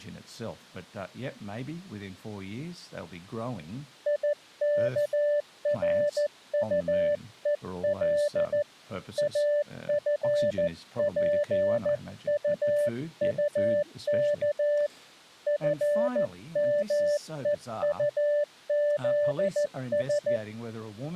Morse code, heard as a keyed tone, hand-sent with a paddle, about 14 wpm, 590 Hz, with speech in English. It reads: IKRUEL AFPUUK FMEUZS